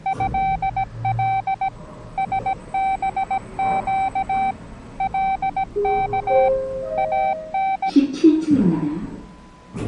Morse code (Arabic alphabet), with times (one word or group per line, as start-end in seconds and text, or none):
0.1-1.7 هل
2.2-4.5 سبق
5.0-6.5 لك
7.0-7.9 ان